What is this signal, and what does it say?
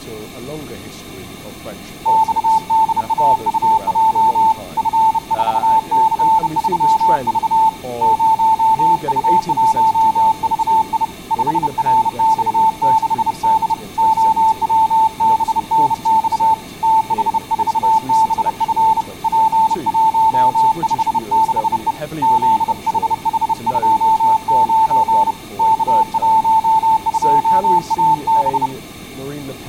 Morse code, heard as a keyed tone, hand-sent with a bug key, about 30 wpm, 890 Hz, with speech in English. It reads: XDAUJ F4C3V 0U1VI 5RX6D OWBNX TH4BF P156E ZHH29 K12AB